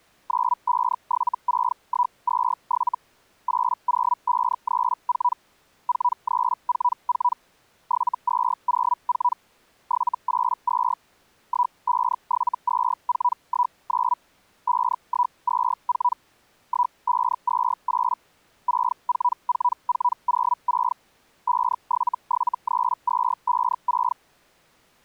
Hellschreiber (Feld-Hell, 122.5 baud), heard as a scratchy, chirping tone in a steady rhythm, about 980 Hz. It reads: 9576127 80534 4344 7204 782 1572419 5124 1528 644406 5773256